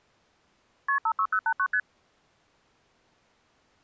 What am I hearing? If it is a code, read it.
Multi-frequency trunk signalling (R1, as on North American trunks), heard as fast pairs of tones, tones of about 70 ms. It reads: KP 56089 ST